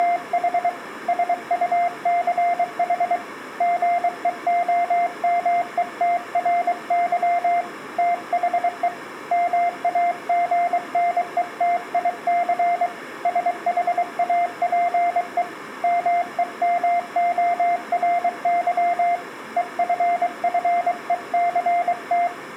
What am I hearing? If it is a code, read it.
Morse code, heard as a keyed tone, hand-sent with a paddle, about 23 wpm, 700 Hz. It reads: … SUCH GEOMETRY THE MAGNETIC SHAPE MEMORY EFFECT